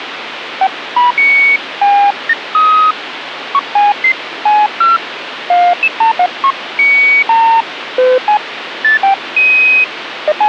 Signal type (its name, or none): none